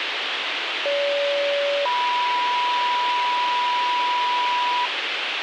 Two-tone page, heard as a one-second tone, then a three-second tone, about 570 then 980 Hz, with radio hiss.